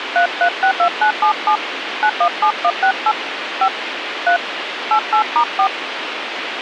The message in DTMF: 3362977 917168 5 3 88*4

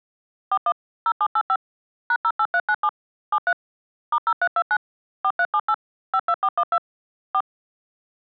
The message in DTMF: 41 0785 #08397 73 *0329 4378 52412 4

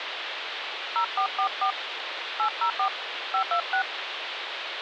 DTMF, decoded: 0444 804 526

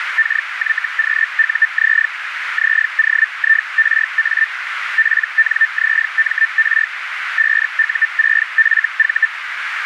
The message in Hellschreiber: KYQUZ ZOIRA PNZMR 5U6FV

